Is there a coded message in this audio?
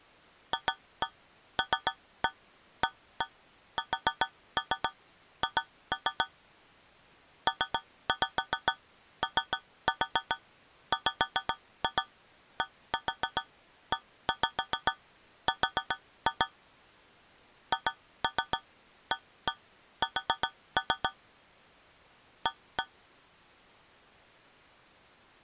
Yes: tap code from 0.5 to 22.9 s, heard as taps on a metal pipe, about 7 knocks a second. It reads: FLASH POWDER HAS A